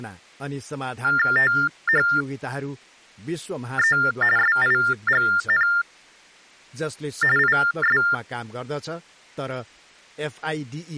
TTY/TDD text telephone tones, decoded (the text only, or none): THE SIGN IS